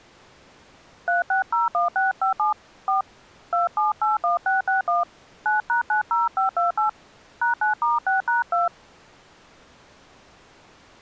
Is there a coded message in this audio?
Yes: DTMF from 1.1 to 8.7 s, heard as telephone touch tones, dialled by hand, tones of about 140 ms. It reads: 3601657 4 2781661 9#90528 #9*6#2